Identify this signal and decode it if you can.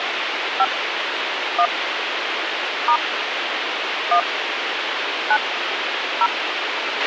DTMF, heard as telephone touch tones, dialled by hand, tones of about 70 ms, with radio hiss and a squelch burst at the end. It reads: 5 1 * 1 9 0